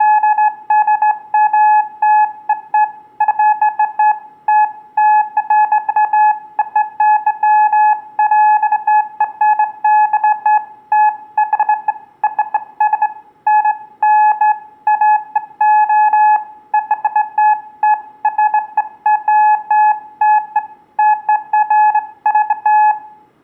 Beeps of irregular length, with room echo. There is no code.